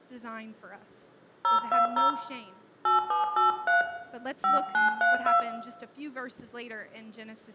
DTMF, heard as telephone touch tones, dialled by hand, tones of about 140 ms, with room echo. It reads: 020 8783 5932